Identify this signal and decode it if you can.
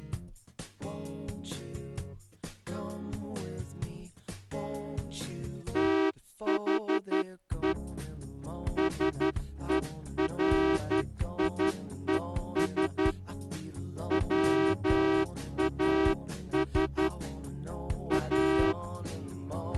Morse code, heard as a horn, hand-sent with a straight key, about 11 wpm. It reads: THE SERIES WAS A